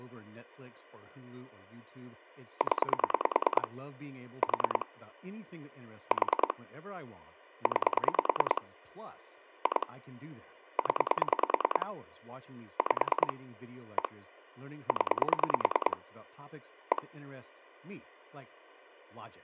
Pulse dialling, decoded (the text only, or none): 0 4 4 9 2 0 5 1 0 1